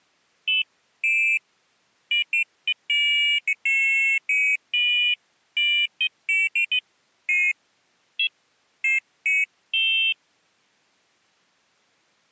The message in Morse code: none

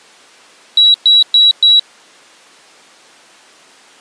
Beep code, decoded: 4 short

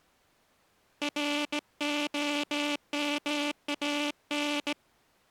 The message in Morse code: ROMAN

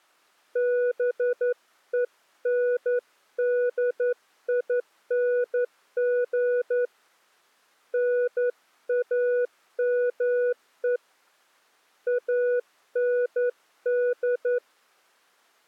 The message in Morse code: BENDING NAME AND

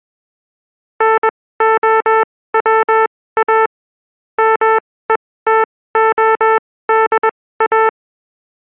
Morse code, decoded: NOWA METODA

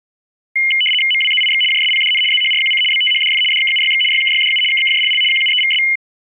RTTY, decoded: MWZIX JSPDN ZHRQC BTHDF DKUYX YKYDU KKJLL QUEVS

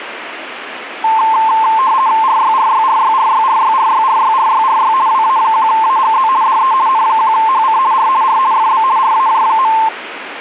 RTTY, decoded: RYRYRYRYRYRYRYRYRY WA1AGZ DE N1HC R R FB RAJ.

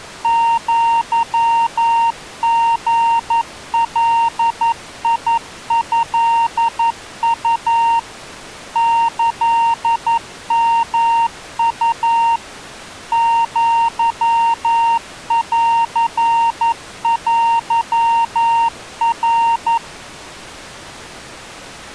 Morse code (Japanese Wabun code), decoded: アリガトウ キヨウ アンテナ

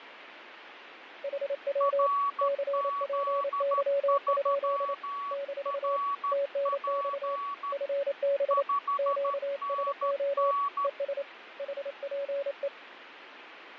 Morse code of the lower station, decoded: HW CPY? - TNX FB QSO ES HPE

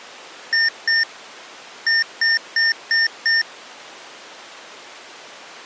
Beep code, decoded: 2-5

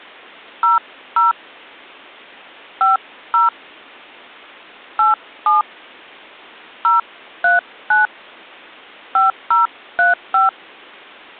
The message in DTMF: 00 50 87 039 5035

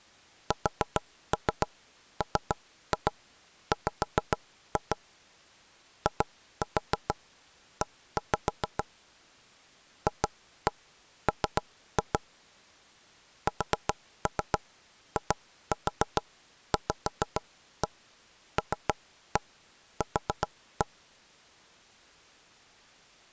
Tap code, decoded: SMW IE FM SIVLQ

